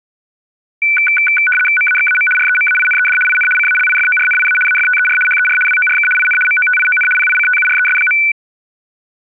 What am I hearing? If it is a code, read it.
RTTY (75 baud, 850 Hz shift), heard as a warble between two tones, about 1900 Hz centre. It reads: MAXAM REMAINED IN CALIFORNIA AFTER HER WORK IN MOTION PICTURES.